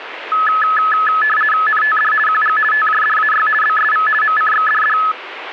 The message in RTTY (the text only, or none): NTD QG TJDAY BSV MCXDD